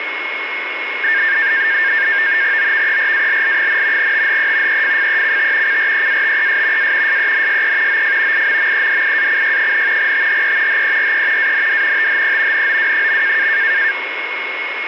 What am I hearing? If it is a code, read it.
NAVTEX (SITOR-B), 100 baud, 170 Hz shift, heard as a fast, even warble, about 1700 Hz centre, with radio static and a steady whistle near 2170 Hz. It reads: OVERALL, THE EFFECT CREATES A SENSE OF IMMEDIACY, THE HERE AND THE NOW.